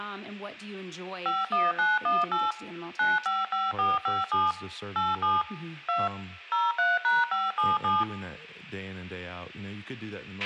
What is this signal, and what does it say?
DTMF, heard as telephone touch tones, dialled by machine, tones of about 190 ms, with a squelch burst at the end, room echo and speech in English. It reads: 51918 955457 87 2 03#577